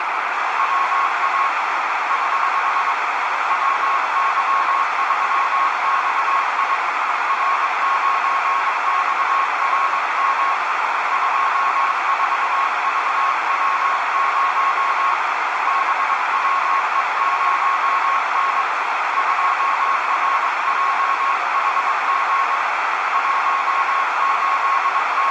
Morse code, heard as a keyed tone, hand-sent with a paddle, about 22 wpm, 1090 Hz, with heavy radio static and a narrow filter. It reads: WA <HH> WY3XI R9XRM 24VW0 BWE0N 2RJHG …